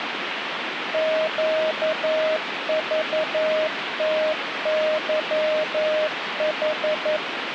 Morse code, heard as a keyed tone, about 11 wpm, 620 Hz, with radio static. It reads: QVTYH